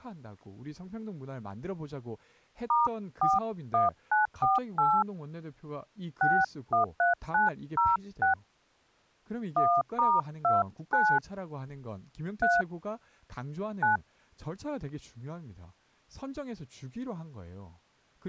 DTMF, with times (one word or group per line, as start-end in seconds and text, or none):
2.7-5.0 *41948
6.2-8.3 613906
9.6-11.2 1*29
12.4-12.6 3
13.8-14.0 9